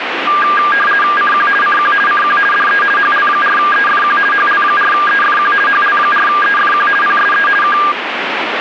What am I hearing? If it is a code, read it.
RTTY (50 baud, 450 Hz shift), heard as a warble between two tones, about 1410 Hz centre, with radio static. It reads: CQ CQ CQ DE HL4EFQ HL4EFQ HL4EFQ PSE K